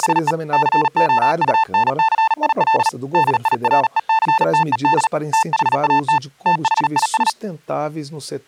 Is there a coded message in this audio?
Yes: Morse code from 0.0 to 7.4 s, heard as a keyed tone, hand-sent with a paddle, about 38 wpm, 890 Hz, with speech in Portuguese. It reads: … COUNCIL DIRECTED THAT THIS